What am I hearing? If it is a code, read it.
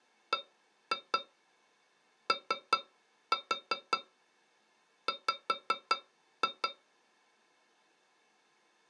Tap code, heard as taps on a metal pipe, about 5 knocks a second. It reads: BOW